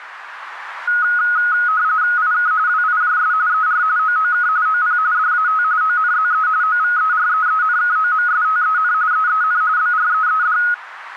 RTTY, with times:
2.2-2.5 IK
2.7-3.3 WIJS
3.5-3.8 ER
4.0-4.5 OOK
4.7-5.0 OP
5.1-5.6 DAT
5.8-6.5 ONZE
6.6-8.9 OVEREENKOMSTEN
9.1-9.6 EEN
9.8-10.6 BREED

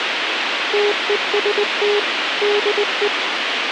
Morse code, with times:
0.7-2.0 TEST
2.4-3.1 DE

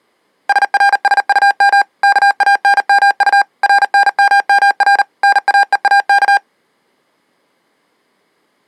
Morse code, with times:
0.5-1.8 SRSUM
2.0-3.4 KANMU
3.6-5.0 RNMMR
5.2-6.4 NAEAK

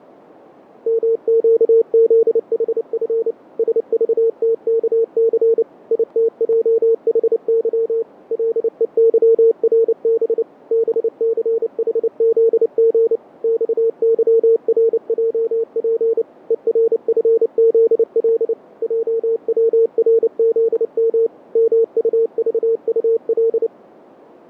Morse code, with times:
0.9-3.3 MQZHF
3.6-5.6 SVTKC
5.9-8.0 ITJHY
8.3-10.4 LEYRB
10.7-13.2 BCHZG
13.4-16.2 XYRJP
16.5-18.5 ERFZL
18.8-21.3 JWRZM
21.6-23.7 MUVUL

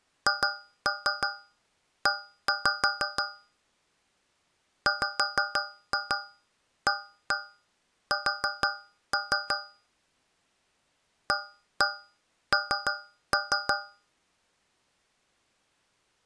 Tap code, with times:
0.3-3.2 HE
4.9-9.6 WAS
11.3-13.7 AN

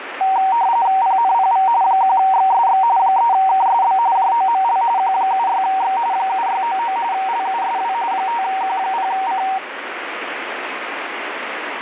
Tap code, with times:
none

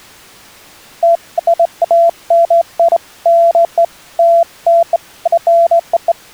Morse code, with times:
none

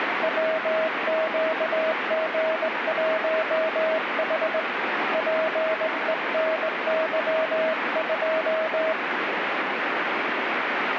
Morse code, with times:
0.2-4.6 WQG1H
5.1-8.9 PENY2

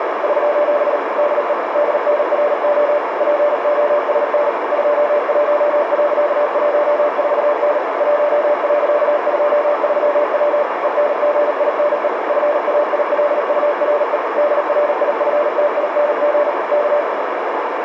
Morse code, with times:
0.2-1.0 <SOS>
1.2-1.5 DE
1.7-3.0 DNRO
3.2-4.5 POSN
4.7-7.8 21.14N
8.0-10.6 1.23W
10.8-12.1 ENGINE
12.3-14.2 FAILURE
14.4-16.5 DRIFTING
16.7-17.0 K

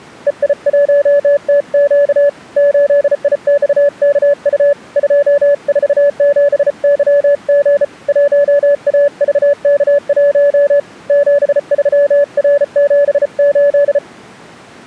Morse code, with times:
0.3-2.3 EI1TQ
2.6-4.7 8IXKU
5.0-7.8 247YG
8.1-10.8 1AVK1
11.1-14.0 73R78

